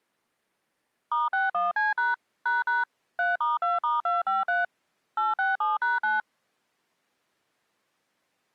DTMF, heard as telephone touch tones, dialled by machine, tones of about 170 ms. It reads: *61C# ## 3*2*253 867#9